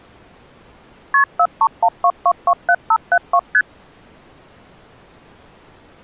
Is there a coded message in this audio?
Yes: multi-frequency trunk signalling (R1, as on North American trunks) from 1.1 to 3.6 s, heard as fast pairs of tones, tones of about 60 ms. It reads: KP 4312227572 ST